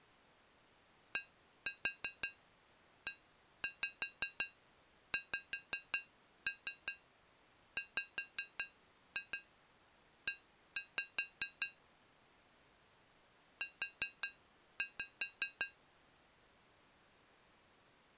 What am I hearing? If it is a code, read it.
Tap code, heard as taps on glass, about 5 knocks a second. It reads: DEXWE U